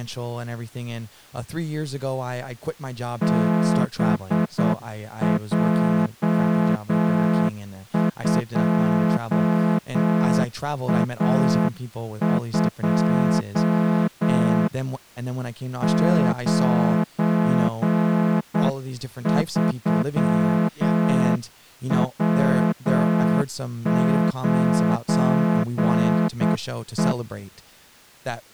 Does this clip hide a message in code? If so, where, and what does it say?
Yes: Morse code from 3.2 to 27.2 s, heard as a horn, hand-sent with a straight key, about 8 wpm, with speech in English. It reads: BJ2A2 93W9E